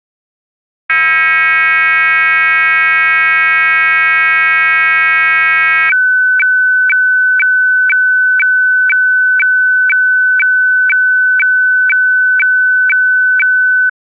Weather fax (radiofax), 120 lines a minute, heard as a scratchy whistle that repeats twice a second.